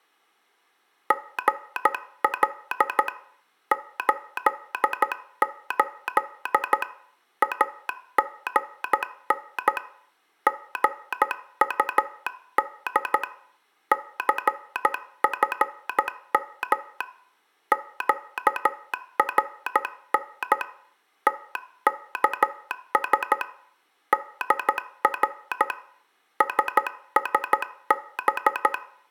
Morse code, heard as a telegraph sounder, hand-sent with a paddle, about 13 wpm, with room echo. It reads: GL 88 AGN GUD CFM QRN TKS DR SSB